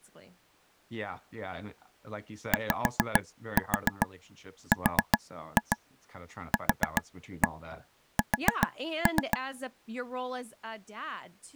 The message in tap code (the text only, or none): YRQS